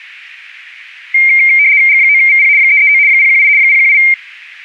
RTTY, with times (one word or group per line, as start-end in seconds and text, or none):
1.9-2.5 G9VP
2.6-3.0 339
3.1-3.5 018
3.6-4.0 018